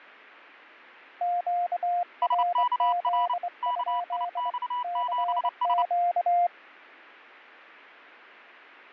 Morse code, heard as two keyed tones, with fading. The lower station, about 23 wpm, 700 Hz: QRZ? CQ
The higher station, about 29 wpm, 980 Hz: SKR KIX7S